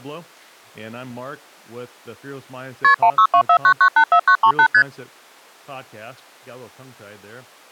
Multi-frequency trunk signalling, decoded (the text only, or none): KP 16249984938 ST